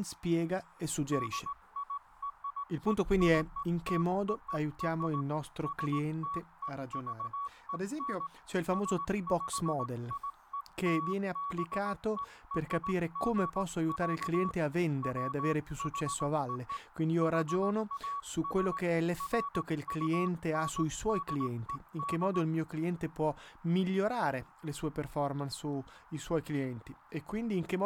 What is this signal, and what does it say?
Morse code (American railroad code), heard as a keyed tone, hand-sent with a straight key, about 1130 Hz, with speech in Italian. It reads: DIRECTOR STEVEN SPIELBERG, WHO HAS FUNDED